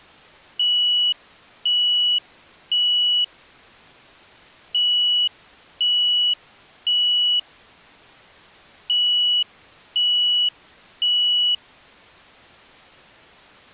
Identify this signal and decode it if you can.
Alarm pattern, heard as an alarm's beeps, played three times, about 2950 Hz. Temporal three. Smoke or fire, evacuate.